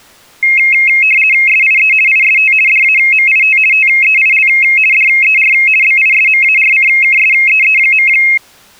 RTTY (50 baud, 450 Hz shift), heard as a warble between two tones, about 2350 Hz centre. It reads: SIE IST DAMIT TEIL DER BISMARCKSEE.